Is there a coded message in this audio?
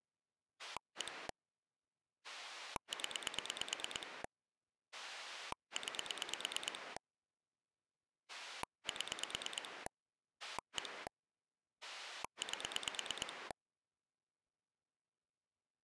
Yes: pulse dialling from 0.6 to 13.5 s, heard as a rotary dial, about 9 pulses a second. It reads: 1 0 9 7 1 8